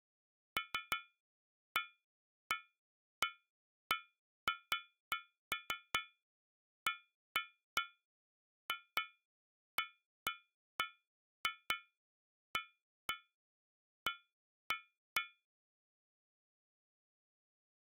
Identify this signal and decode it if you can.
Irregular taps on a metal pipe. There is no code.